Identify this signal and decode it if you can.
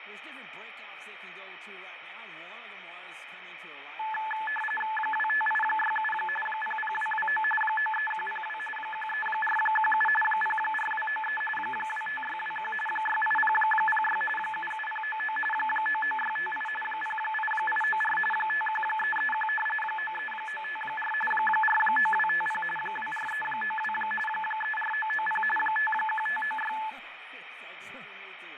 RTTY (45.45 baud, 850 Hz shift), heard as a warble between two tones, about 1300 Hz centre, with radio static and fading. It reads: 25867 00229 93102 13417 04293 25621 68006 77099 99658 08894 51331 93954 49250 24392 34990 51596